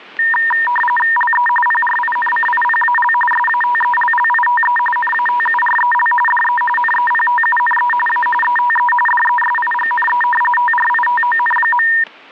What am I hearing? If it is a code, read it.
RTTY (45.45 baud, 850 Hz shift), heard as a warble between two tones, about 1400 Hz centre, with static crashes. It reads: LE PRINCIPAL SATELLITE NATUREL DE NEPTUNE A ETE DESIGNE TRITON.